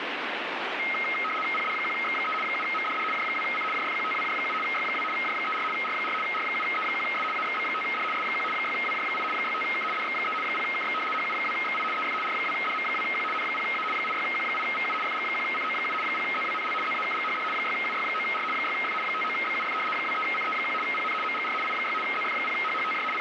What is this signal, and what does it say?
RTTY (75 baud, 850 Hz shift), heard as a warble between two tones, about 1700 Hz centre, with radio static. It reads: PD1X3 7MDD J2C JFQTWJ7 Y2 J34 R4 R7E1S AXB5D S1 6WJ8 65K DX3 0KX HU2XI EF R2DM2Q N0A 86Q8VU FG1CO7 0ZWNL ZAKGHD 6UY9R 6F 59BUF 23CE1 PN MGR I6 ZF0HHTJ …